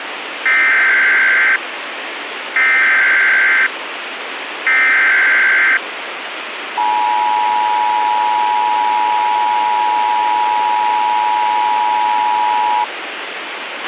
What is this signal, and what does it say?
Emergency Alert System (SAME) tones (header bursts, then the 853 and 960 Hz attention tone), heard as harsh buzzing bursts, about 520.83 baud, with radio hiss and a squelch burst at the end.